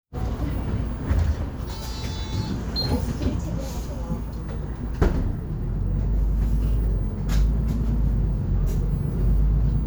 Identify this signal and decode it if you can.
The noise inside a bus. There is no code.